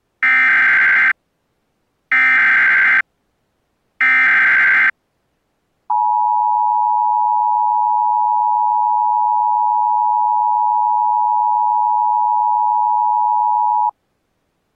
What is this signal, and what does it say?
Emergency Alert System (SAME) tones (header bursts, then the 853 and 960 Hz attention tone), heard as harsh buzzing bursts, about 520.83 baud.